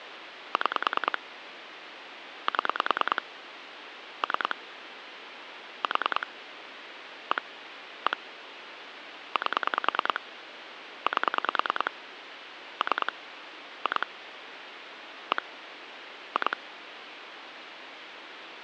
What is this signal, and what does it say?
Pulse dialling, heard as clicks on a phone line, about 10 pulses a second, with phone line noise. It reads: 6 7 3 4 1 1 8 8 3 2 1 2